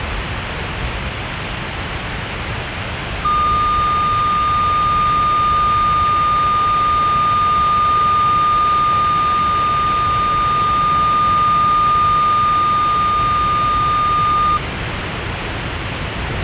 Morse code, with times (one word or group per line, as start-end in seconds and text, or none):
none